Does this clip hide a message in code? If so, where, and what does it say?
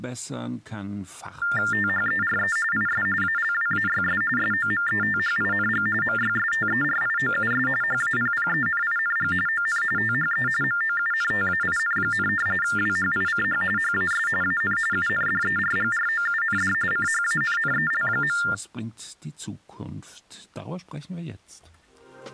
Yes: TTY/TDD text telephone tones (45.45 baud Baudot) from 1.4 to 18.5 s, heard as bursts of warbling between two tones, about 400 Hz shift, 1600 Hz centre. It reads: THERE IS ALWAYS SOMETHING MYSTERIOUS HAPPENING ON THE MOUNTAIN, WHICH HAS AN UNDERGROUND CHANNEL.